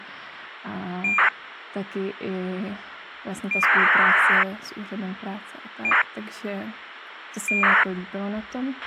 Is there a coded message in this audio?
Yes: ACARS aircraft data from 1.0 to 7.8 s, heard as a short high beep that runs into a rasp, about 2400 baud, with radio hiss, a squelch burst at the end and speech in Czech.